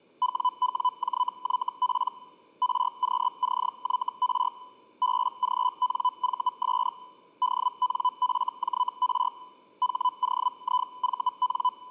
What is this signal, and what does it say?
Hellschreiber (Feld-Hell, 122.5 baud), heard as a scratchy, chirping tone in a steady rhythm, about 1000 Hz. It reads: WWJYP RQCYR BGNVS DNFJR HOIVN